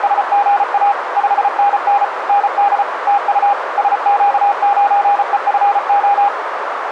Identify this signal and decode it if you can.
Morse code, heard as a keyed tone, machine-sent, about 34 wpm, 810 Hz, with radio static and a narrow filter. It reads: … 5NN ND TU SQ9EFO